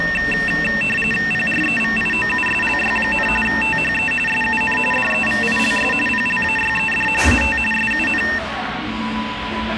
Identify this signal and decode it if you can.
RTTY (45.45 baud, 850 Hz shift), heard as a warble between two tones, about 2250 Hz centre, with radio static and the noise of a crowd indoors. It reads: PREVIOUSLY, THE SUN DEVILS PLAYED AT SUN